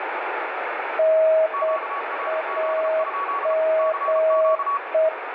Morse code, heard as two keyed tones, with heavy radio static. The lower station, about 8 wpm, 640 Hz: NAME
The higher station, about 33 wpm, 1130 Hz: QRZ? CQ